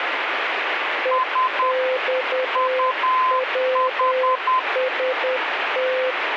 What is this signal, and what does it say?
Morse code, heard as two keyed tones, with heavy radio static. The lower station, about 10 wpm, 520 Hz: EXWST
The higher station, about 10 wpm, 1030 Hz: S UH